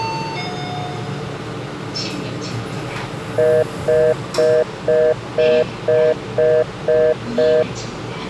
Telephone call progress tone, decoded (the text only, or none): congestion tone